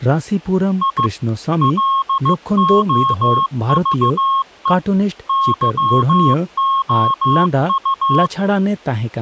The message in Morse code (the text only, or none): I LOVE YOU